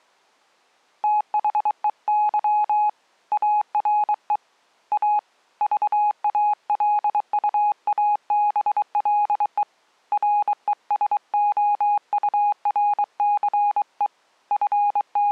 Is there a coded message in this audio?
Yes: Morse code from 1.0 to 15.3 s, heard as a keyed tone, hand-sent with a bug key, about 23 wpm, 830 Hz. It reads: THEY ARE A VALUABLE RESOURCE …